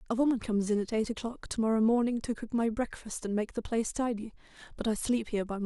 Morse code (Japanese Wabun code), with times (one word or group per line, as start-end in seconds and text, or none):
none